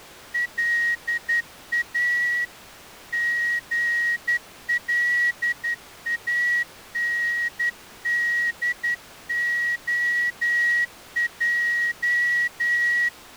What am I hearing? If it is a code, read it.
Morse code, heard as a whistle, hand-sent with a straight key, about 11 wpm. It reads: LA GLANDOJ